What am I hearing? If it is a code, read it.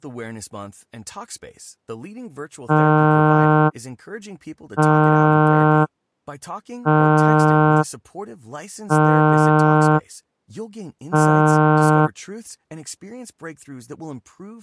Ship horn signal, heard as a ship's horn, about 150 Hz, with speech in Spanish. 5 short. At sea: I doubt that you are doing enough to avoid a collision.